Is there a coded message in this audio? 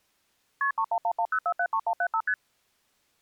Yes: multi-frequency trunk signalling (R1, as on North American trunks) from 0.6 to 2.3 s, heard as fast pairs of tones, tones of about 70 ms. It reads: KP 31110473175 ST